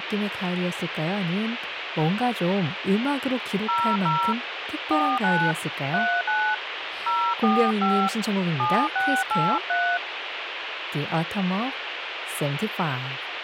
DTMF, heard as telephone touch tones, dialled by hand, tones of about 270 ms, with radio hiss and speech in Korean. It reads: 00 49 39 045 7683